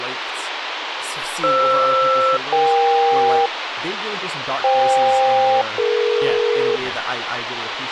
Aircraft SELCAL, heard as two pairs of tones, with radio hiss and speech in English. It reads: FR-EK FK-DE